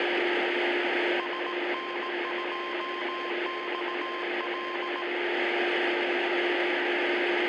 Morse code, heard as a keyed tone, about 18 wpm, 1050 Hz, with radio static, a steady whistle near 350 Hz and room echo. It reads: SN2XL